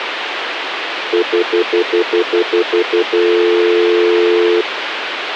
Telephone call progress tone (North American plan), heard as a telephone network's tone, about 350, 440 Hz, 0.1 s on and 0.1 s off, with phone line noise. Stutter dial tone.